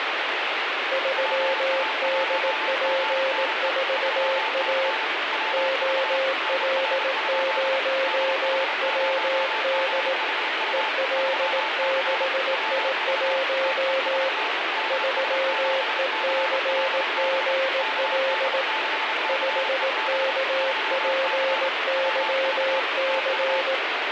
Morse code, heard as two keyed tones, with radio static. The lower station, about 18 wpm, 530 Hz: 3DP4A OL0WD EL6I1 3ECGL 5KPYC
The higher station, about 30 wpm, 880 Hz: PA1GNE 3C WV NR? DH0GHU 3C WV TEST DS7CLB KD6CEB 3C WV TU